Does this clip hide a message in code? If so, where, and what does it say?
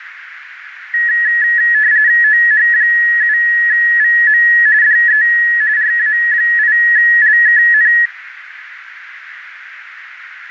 Yes: RTTY (45.45 baud, 170 Hz shift) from 0.9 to 8.1 s, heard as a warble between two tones, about 1800 Hz centre, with radio static. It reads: OH7VM DE RA8LKN